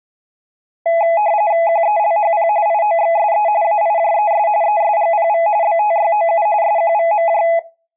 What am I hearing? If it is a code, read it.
RTTY (45.45 baud, 170 Hz shift), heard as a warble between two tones, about 750 Hz centre. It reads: QELHP IOXSE AIJES ESGPV BTYOU SQVMJ